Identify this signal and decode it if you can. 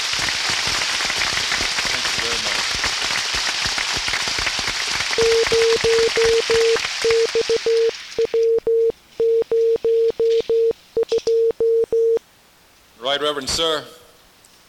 Morse code, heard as a keyed tone, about 15 wpm, 460 Hz. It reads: 0XW02